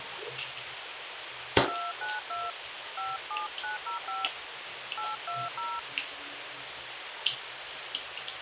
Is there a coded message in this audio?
Yes: DTMF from 1.7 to 5.8 s, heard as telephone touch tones, dialled by hand, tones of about 180 ms, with radio hiss and the noise of a restroom. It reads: 292 57905 820